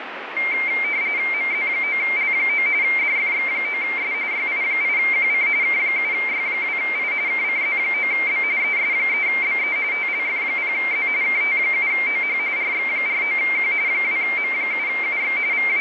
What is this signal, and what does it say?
RTTY (45.45 baud, 170 Hz shift), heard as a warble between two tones, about 2200 Hz centre, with radio static. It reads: MZ9L9 DFX9S YI8QC K7Y2I KCZ9B ES3BE TLF0Z KT7OH RX49Q 2M7UX …